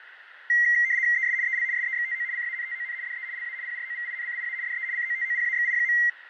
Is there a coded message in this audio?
Yes: RTTY (75 baud, 170 Hz shift) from 0.5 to 6.1 s, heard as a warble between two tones, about 2000 Hz centre, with radio static, fading and a narrow filter. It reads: ES EL SEXTO CANTON DE LA PROVINCIA DE COTOPAXI.